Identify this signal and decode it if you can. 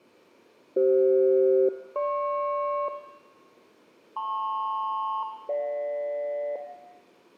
Aircraft SELCAL, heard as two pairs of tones, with room echo. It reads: CF-GP LP-GJ